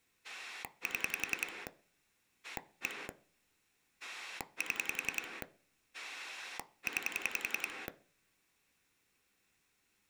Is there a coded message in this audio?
Yes: pulse dialling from 0.2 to 7.9 s, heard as a rotary dial, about 10 pulses a second, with room echo. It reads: 7 1 7 9